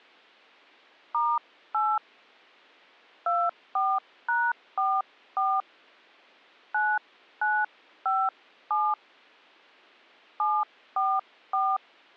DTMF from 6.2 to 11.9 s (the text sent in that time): 9957 744